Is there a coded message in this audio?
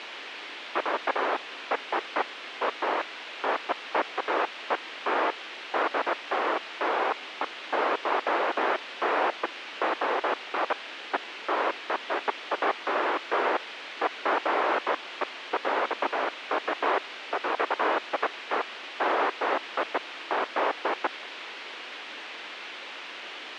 No, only bursts of noise, with radio hiss.